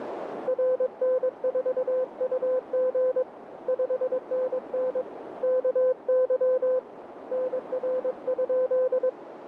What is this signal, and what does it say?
Morse code, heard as a keyed tone, hand-sent with a paddle, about 22 wpm, 510 Hz, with radio static and a narrow filter. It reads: RN4UG 5NN KY NR?